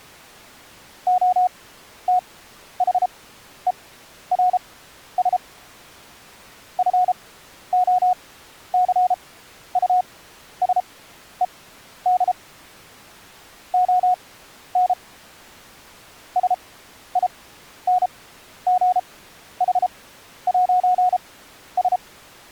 Morse code, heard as a keyed tone, machine-sent, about 33 wpm, spaced as for 12 wpm, 730 Hz. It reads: OTHERS FOCUSED ON SINGH'S